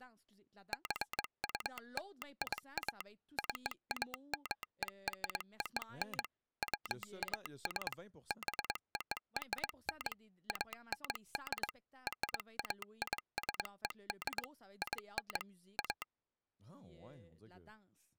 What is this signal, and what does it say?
Morse code (American railroad code), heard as a telegraph sounder, machine-sent, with speech in French. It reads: JULIA CAMERON WAS BORN AND RAISED IN A